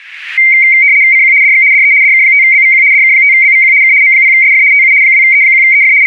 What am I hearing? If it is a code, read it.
RTTY (75 baud, 170 Hz shift), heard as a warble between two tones, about 2200 Hz centre. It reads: CQ DX DE DK5BVQ DK5BVQ K M0SF TU 2E1EF …